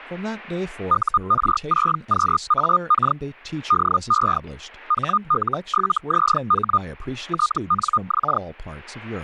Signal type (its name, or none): Hellschreiber